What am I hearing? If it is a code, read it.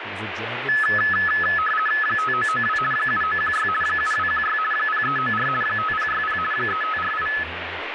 RTTY (50 baud, 450 Hz shift), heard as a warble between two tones, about 1500 Hz centre, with radio static and speech in English. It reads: 5992 7916 7216 0394 5060 3548